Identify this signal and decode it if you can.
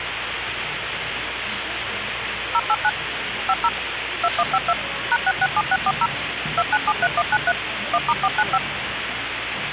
DTMF, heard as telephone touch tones, dialled by machine, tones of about 50 ms, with phone line noise and the noise of a crowd indoors. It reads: 089 50 2152 #667640 2973193 1*495